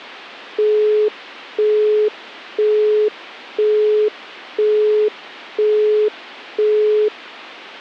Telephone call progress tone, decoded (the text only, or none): busy tone